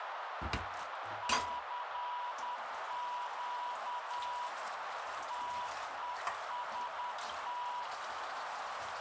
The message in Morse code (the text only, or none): CQ TEST